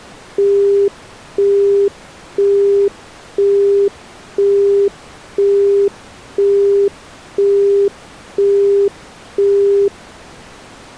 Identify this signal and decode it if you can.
Telephone call progress tone (single-tone plan, as in Europe, Japan and elsewhere), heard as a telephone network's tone, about 400 Hz, 0.5 s on and 0.5 s off. Busy tone.